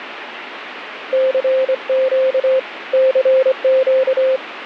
Morse code, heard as a keyed tone, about 25 wpm, 520 Hz, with radio static. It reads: CQ CQ